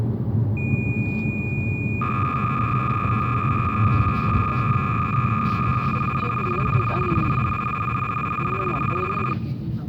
Cassette data (Kansas City type), 300 baud, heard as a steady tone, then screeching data, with the noise inside a car.